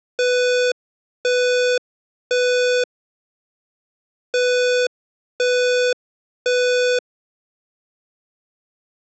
Alarm pattern, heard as an alarm's beeps, played twice, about 500 Hz. Temporal three. Smoke or fire, evacuate.